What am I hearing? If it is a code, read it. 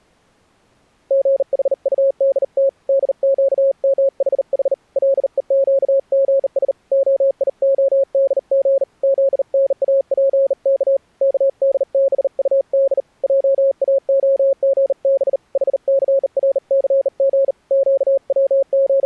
Morse code (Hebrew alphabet), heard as a keyed tone, hand-sent with a bug key, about 39 wpm, 540 Hz. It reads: גחטדת דקמחח לוקגש היהדג זנאפך כדבטד עאהגב חסרסג …